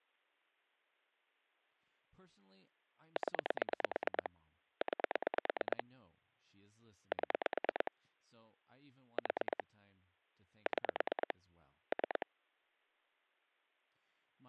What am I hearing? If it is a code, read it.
Pulse dialling, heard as clicks on a phone line, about 9 pulses a second, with speech in English. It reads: 0 9 7 4 6 3